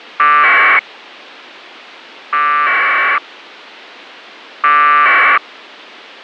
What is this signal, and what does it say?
Packet radio (AX.25, as in APRS), 1200 baud, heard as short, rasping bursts.